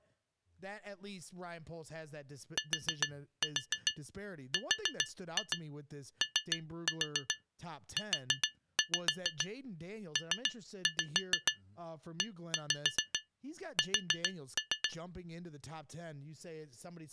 Tap code, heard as taps on glass, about 7 knocks a second, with speech in English. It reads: TROUPES